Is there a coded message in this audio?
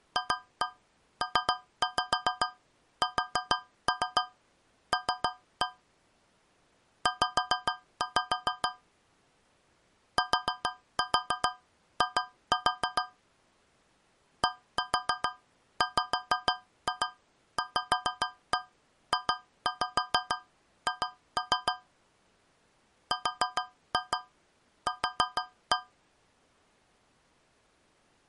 Yes: tap code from 0.2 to 26.0 s, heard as taps on a metal pipe, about 6 knocks a second. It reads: FPSL Z TI DWVJH RQ